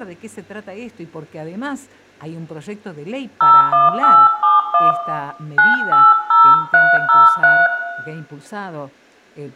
DTMF, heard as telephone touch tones, dialled by hand, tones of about 230 ms, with room echo. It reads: 01871 980303